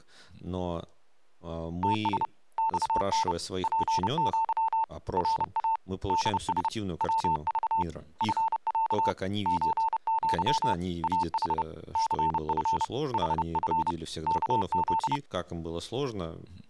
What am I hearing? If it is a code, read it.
Morse code (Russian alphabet), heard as a keyed tone, hand-sent with a paddle, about 30 wpm, 900 Hz, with speech in Russian. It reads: ТС ЬН ПЪ РА ДС ВЖ ФЯ ЧЪ АХ ЦФ ХФ КЗ